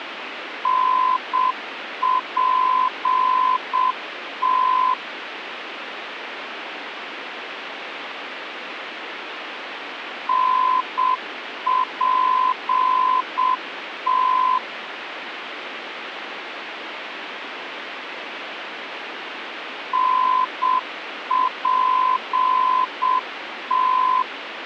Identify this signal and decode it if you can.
Morse code, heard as a keyed tone, machine-sent, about 7 wpm, 1020 Hz, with radio static. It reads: NPT NPT NPT